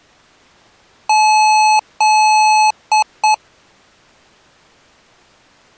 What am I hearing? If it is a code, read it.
Beep code, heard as beeps from a small speaker, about 860 Hz. 2 long, 2 short.